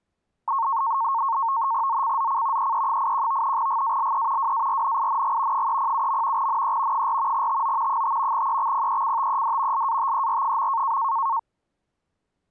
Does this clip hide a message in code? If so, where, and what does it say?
Yes: NAVTEX (SITOR-B), 100 baud, 170 Hz shift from 0.5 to 11.4 s, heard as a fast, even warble, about 1000 Hz centre. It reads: ZCZC EE81 GALE WARNING 307. NE 4 TO 5 EXPECTED LATER.